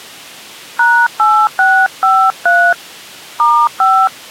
DTMF, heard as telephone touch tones, dialled by hand, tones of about 270 ms. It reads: #8653 *5